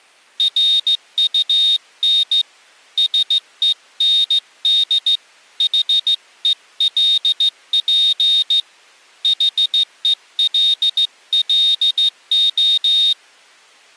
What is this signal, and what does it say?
Morse code, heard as a high beeper, hand-sent with a straight key, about 15 wpm, 3700 Hz. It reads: RUN SEND HELP HELLO